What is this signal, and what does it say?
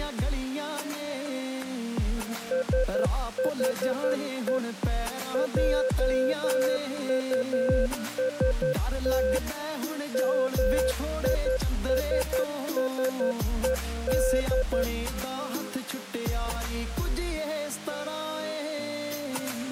Morse code, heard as a keyed tone, machine-sent, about 11 wpm, 520 Hz. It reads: SHE JUST MISSED